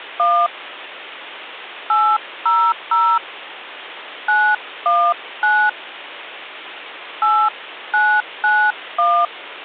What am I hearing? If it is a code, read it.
DTMF, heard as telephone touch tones, dialled by hand, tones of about 270 ms. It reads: 1 800 919 8991